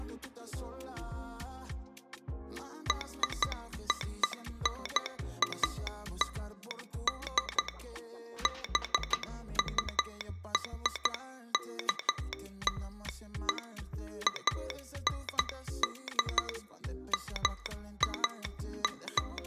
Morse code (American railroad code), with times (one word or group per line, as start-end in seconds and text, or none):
2.9-7.7 RONALD
8.5-13.6 BURKLE
14.3-16.5 AND
17.1-19.5 …